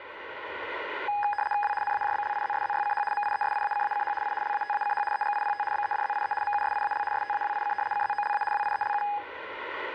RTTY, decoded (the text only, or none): W NAJBLIZSZYCH MIESIACACH I LATACH EGIPT BEDZIE MUSIAL STAWIC CZOLA WIELU